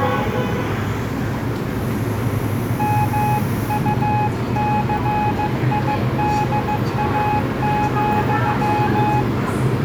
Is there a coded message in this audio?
Yes: Morse code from 2.7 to 9.3 s, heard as a keyed tone, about 15 wpm, 840 Hz, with the noise of a subway station. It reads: MUCIDA,